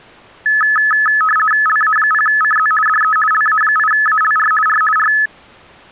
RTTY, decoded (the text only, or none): LA0CZ DE LA8ALR R R